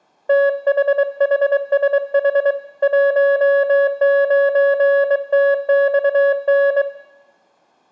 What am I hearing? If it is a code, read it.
Morse code, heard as a keyed tone, hand-sent with a bug key, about 23 wpm, 560 Hz, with room echo. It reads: THHSH 19TXN